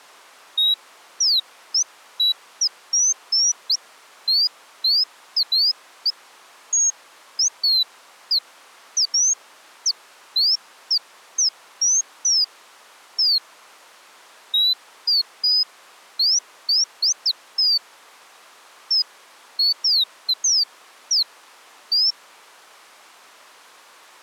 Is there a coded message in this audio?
No, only bird-like chirps.